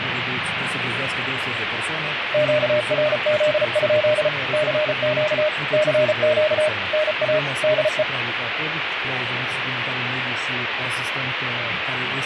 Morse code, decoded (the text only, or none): QRZ? CQ CQ NA DE